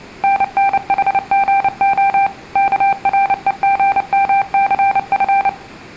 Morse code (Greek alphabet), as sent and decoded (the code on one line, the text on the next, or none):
-. -. .... --. --- / -.- .-. . --. -- -.-. ..-.
ΝΝΗΓΟ ΚΡΕΓΜΘΦ